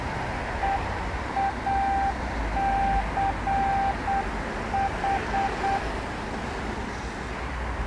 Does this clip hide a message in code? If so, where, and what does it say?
Yes: Morse code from 0.6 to 5.8 s, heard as a keyed tone, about 8 wpm, 790 Hz, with street noise. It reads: EACH